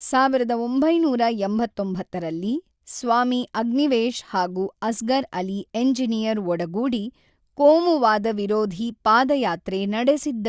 Speech in Kannada. There is no code.